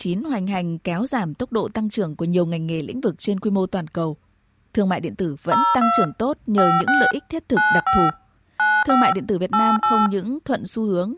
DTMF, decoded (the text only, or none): 02 56 95 95 88